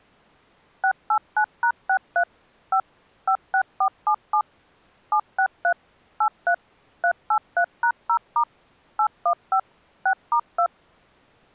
DTMF, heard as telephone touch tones, dialled by machine, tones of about 80 ms. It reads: 689#63 5 56477 763 83 383#0* 815 6*2